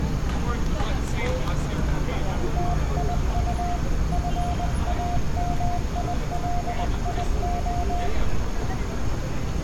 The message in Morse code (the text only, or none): TIU FAMILIO